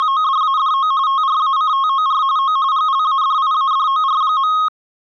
RTTY (45.45 baud, 170 Hz shift), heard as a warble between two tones, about 1170 Hz centre. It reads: … TRACTOR O GLADIADOR.